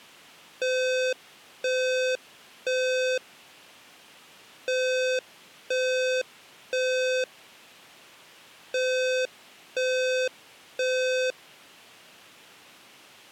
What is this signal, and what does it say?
Alarm pattern, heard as an alarm's beeps, played three times, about 510 Hz. Temporal three. Smoke or fire, evacuate.